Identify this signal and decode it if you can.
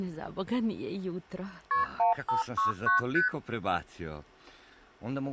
Multi-frequency trunk signalling (R1, as on North American trunks), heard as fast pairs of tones, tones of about 130 ms. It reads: KP 1569 ST